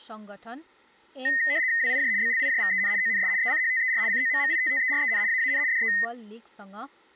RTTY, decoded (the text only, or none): WIJ BLIJVEN ONS ECHTER COMMITTEREN AAN DE